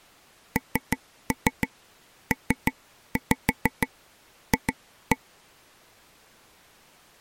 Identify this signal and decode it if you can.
Tap code, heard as taps on a table, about 6 knocks a second. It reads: NPF